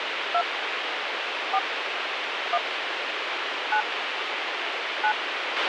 DTMF, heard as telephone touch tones, dialled by hand, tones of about 70 ms, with radio hiss and a squelch burst at the end. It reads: 2 4 1 9 9